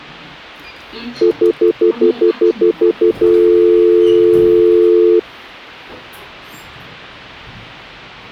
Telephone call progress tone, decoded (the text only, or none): stutter dial tone